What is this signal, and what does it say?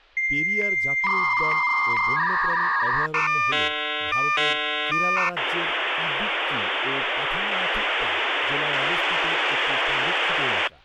Dial-up modem handshake (V.34 or later), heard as a whistle, warbles, then hiss, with speech in Bangla.